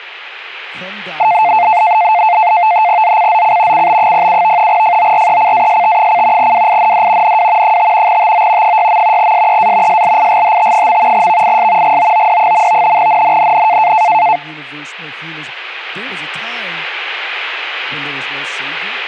NAVTEX (SITOR-B), 100 baud, 170 Hz shift, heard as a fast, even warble, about 790 Hz centre, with speech in English. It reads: ZCZC CB07 FORECAST: WIND NW 5 TO 6. SEA SLIGHT. VIS GOOD. NNNN